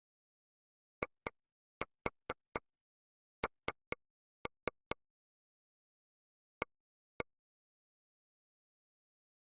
Tap code, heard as taps on a table, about 4 knocks a second. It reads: IN A